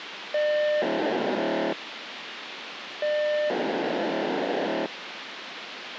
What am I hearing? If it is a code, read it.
POCSAG pager data (1200 baud), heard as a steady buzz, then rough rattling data, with radio hiss.